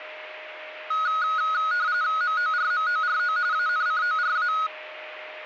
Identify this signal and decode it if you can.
RTTY (45.45 baud, 170 Hz shift), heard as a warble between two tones, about 1360 Hz centre, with a steady whistle near 620 Hz. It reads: MORMORO ANCORA